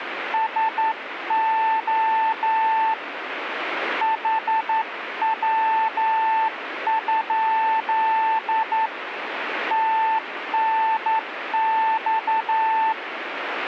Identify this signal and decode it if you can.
Morse code, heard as a keyed tone, hand-sent with a straight key, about 11 wpm, 890 Hz, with radio static. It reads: SO HW? TNX